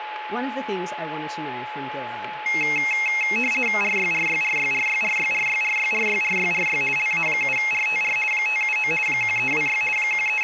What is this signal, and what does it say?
RTTY (50 baud, 450 Hz shift), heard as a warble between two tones, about 2350 Hz centre, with radio static, a steady whistle near 850 Hz and speech in English. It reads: RYRYRYRYRYRYRYRYRYRY LA7RTR 579 1326 …